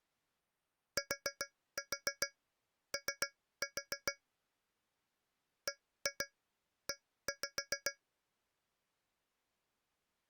Tap code, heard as taps on a metal pipe, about 7 knocks a second. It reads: TO BE